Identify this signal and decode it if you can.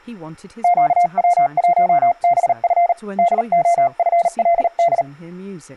Morse code, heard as a keyed tone, hand-sent with a paddle, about 38 wpm, 690 Hz, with speech in English. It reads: QW1BF DOFLD